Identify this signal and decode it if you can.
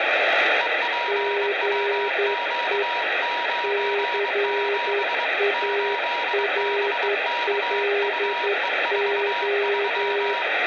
Morse code, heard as two keyed tones, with radio static and room echo. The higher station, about 23 wpm, 960 Hz: EPWQ97 8BKUE43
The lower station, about 11 wpm, 400 Hz: GE CARLO